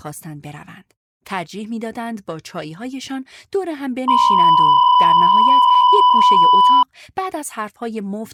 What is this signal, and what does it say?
PSK63 (62.5 baud), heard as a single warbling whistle, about 1000 Hz, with speech in Persian.